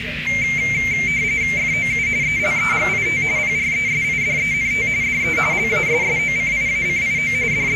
RTTY (45.45 baud, 170 Hz shift), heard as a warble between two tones, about 2200 Hz centre, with radio static, a narrow filter and the noise of a restaurant. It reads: FOU ELEGIT PRESIDENT DE LASSOCIACIO …